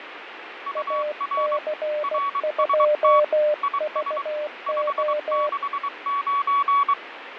Morse code, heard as two keyed tones, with radio static and fading. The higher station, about 23 wpm, 1130 Hz: UR RST IS 569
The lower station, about 16 wpm, 600 Hz: AC2VO